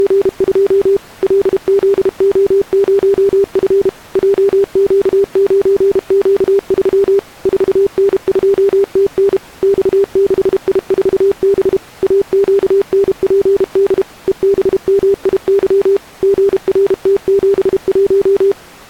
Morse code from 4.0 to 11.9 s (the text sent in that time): JQ9Q3 4N2TN X6I4B